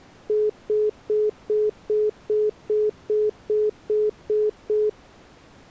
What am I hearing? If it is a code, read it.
Telephone call progress tone (single-tone plan, as in most of Europe), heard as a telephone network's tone, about 420 Hz, 0.2 s on and 0.2 s off. Congestion tone.